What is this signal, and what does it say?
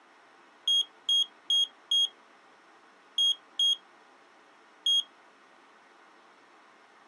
Beep code, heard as a piezo beeper, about 3250 Hz. 4-2-1. In Phoenix BIOS tables: timer tick failure.